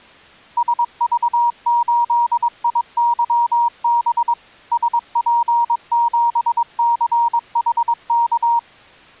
Morse code, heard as a keyed tone, machine-sent, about 22 wpm, 940 Hz. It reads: SV8IYB SP7CHK